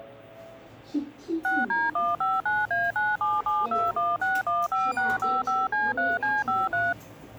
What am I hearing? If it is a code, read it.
DTMF, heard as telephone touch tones, dialled by machine, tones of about 200 ms, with the noise inside a lift. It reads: 6D159A97721615655C3C53